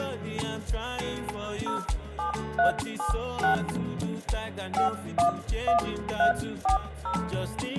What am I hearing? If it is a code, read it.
DTMF, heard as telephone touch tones, dialled by hand, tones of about 120 ms, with room echo. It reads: 07376 511340